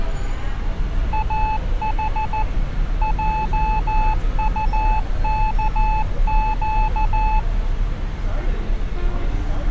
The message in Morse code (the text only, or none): AH JUKQ